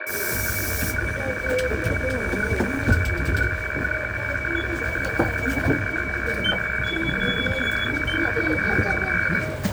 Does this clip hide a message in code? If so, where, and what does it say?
Yes: weather fax (radiofax), 120 lines a minute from 0.0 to 9.4 s, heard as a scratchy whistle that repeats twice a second, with radio static, room echo and the noise inside a bus.